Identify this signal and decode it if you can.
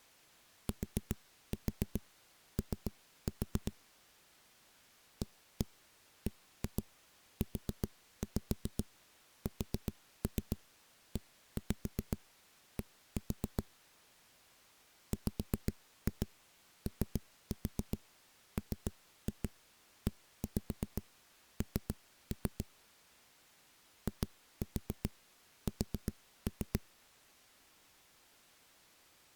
Tap code, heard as knocks on a wall, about 7 knocks a second. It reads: TO ABUSED WOMEN IS